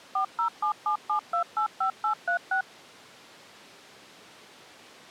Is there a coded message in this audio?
Yes: DTMF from 0.2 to 2.6 s, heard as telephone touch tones, dialled by machine, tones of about 100 ms. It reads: 40777285836